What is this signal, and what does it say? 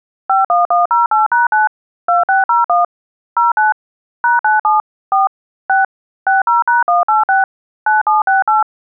DTMF, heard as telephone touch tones, dialled by machine, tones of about 150 ms. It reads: 51108#9 2601 09 #97 4 6 60#186 9768